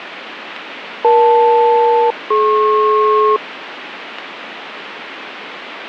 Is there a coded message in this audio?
Yes: aircraft SELCAL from 1.0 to 3.4 s, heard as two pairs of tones, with radio static. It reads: EL-DP